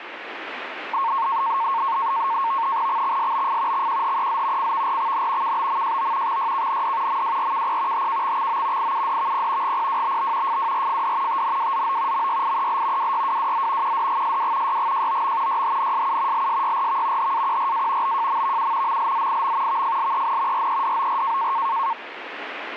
NAVTEX (SITOR-B), 100 baud, 170 Hz shift, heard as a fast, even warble, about 1000 Hz centre, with radio static. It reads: XXSBF XQHEZ CVRXN KBMJO XYKND MWRKP HKXXO IUDVP GPWBB FWRFD TNWZO MYIEL WYWWZ QDGSW YGJOM YHNSU LSYRV HAQRA BJMVU MLZIM VFLEN REDOR